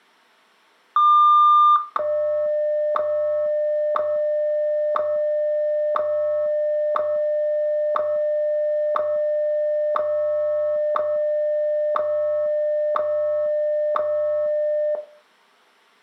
Radio time signal (WWVH, Hawaii), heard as ticks, one a second, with room echo.